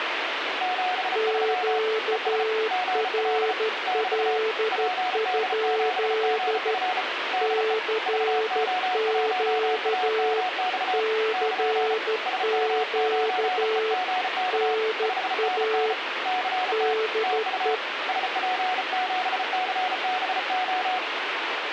Morse code, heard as two keyed tones, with radio static. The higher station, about 34 wpm, 740 Hz: 73 ES GL <BT> PD7GF DE VO1AMX <KN> SM9EGK 5NN CT TU SP7CBO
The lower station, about 13 wpm, 440 Hz: QRL? CQ CQ NA DE